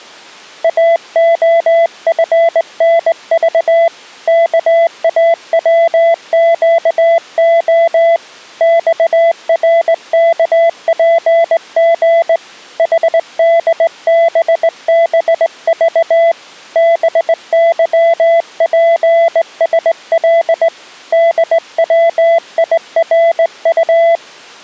Morse code, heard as a keyed tone, hand-sent with a straight key, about 19 wpm, 670 Hz. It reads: AOFNV KAWQO XRKPG HDBBV BYPSL DWIRU